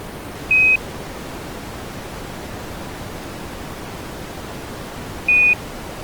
Quindar tones, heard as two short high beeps.